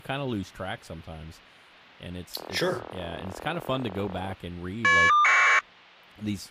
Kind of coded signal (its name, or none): caller ID data burst